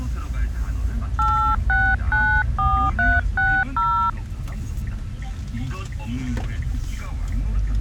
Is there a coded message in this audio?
Yes: DTMF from 1.2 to 4.1 s, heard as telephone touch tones, dialled by hand, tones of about 290 ms, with the noise inside a car. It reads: 8694360